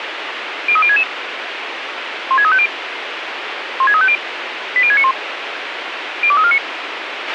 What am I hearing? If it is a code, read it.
Five-tone selective call (ZVEI), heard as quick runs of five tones, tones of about 70 ms, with radio hiss and a squelch burst at the end. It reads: 03066 16350 16350 80691 02349